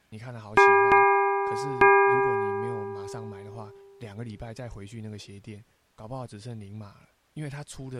Ship's bell, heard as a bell, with speech in Chinese. 3. Three half-hours of the watch have passed.